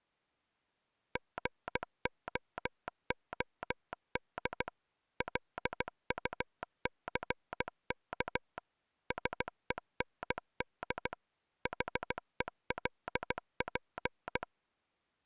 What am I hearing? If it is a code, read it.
Morse code, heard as a telegraph sounder, machine-sent, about 16 wpm. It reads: GOOD LUCK SEND HELP